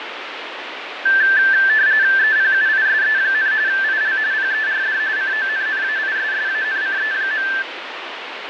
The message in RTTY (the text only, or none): EPUISE, IL PERD CONNAISSANCE.